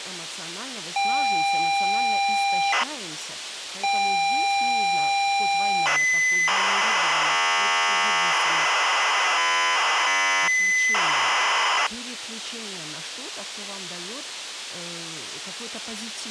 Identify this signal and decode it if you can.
ZX Spectrum tape loading, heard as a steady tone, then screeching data, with speech in Russian.